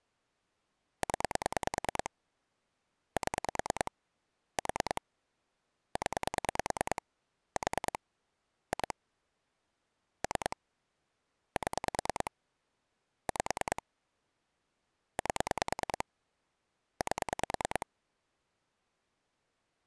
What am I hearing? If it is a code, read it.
Pulse dialling, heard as clicks on a phone line, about 9 pulses a second. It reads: 0 7 4 0 4 2 3 7 5 8 8